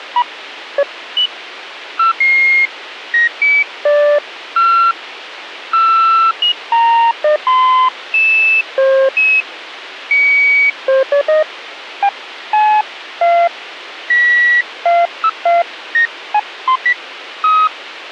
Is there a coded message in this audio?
No, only electronic bleeps of random pitch and length, with radio hiss.